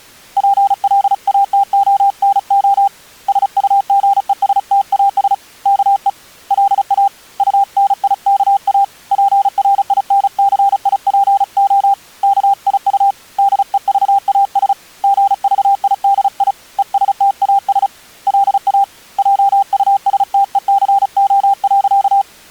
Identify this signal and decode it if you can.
Morse code, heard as a keyed tone, hand-sent with a paddle, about 35 wpm, 800 Hz. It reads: PLATONO SUGESTAS KE LA UNIKA PRINCIPO KIU DEVAS GVIDI ESTAS LA JUSTECO.